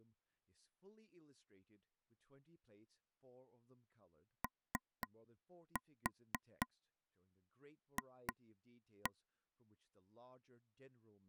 Tap code, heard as taps on a table, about 4 knocks a second, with speech in English. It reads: OF